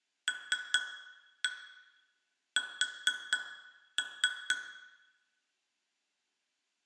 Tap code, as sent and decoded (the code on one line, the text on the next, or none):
3-1 4-3
LS